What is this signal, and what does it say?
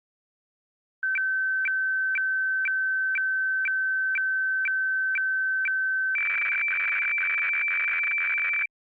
Weather fax (radiofax), 120 lines a minute, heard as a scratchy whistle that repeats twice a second.